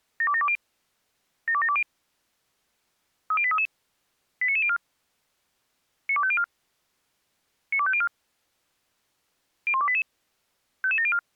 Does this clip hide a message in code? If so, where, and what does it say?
Yes: five-tone selective call (ZVEI) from 0.2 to 11.2 s, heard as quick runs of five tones, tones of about 70 ms. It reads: 72720 72720 30833 89904 92504 92504 01288 55704